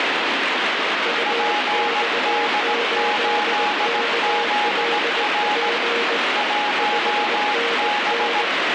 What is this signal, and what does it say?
Morse code, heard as two keyed tones, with heavy radio static. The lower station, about 19 wpm, 470 Hz: UX8KLP 5NN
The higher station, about 17 wpm, 830 Hz: PD8ZR 1B